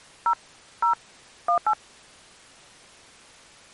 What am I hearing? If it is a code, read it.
DTMF, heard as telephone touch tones, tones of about 100 ms. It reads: 0 0 18